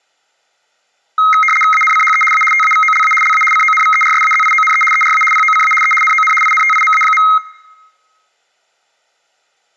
RTTY (75 baud, 850 Hz shift), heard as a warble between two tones, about 1700 Hz centre. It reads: ANCHE A TAVOLA LA CONVERSAZIONE ERA POCA E NON INTIMA.